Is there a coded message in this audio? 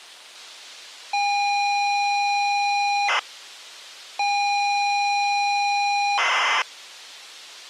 Yes: ZX Spectrum tape loading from 1.1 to 6.6 s, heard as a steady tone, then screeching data.